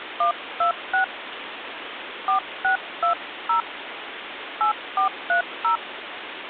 DTMF, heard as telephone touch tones, dialled by hand, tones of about 110 ms, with phone line noise. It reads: 126 4620 8430